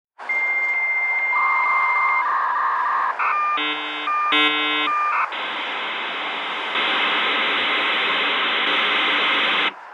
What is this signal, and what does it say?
Dial-up modem handshake (V.34 or later), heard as a whistle, warbles, then hiss, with street noise.